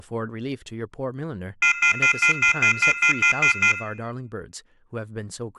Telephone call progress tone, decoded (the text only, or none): off-hook warning tone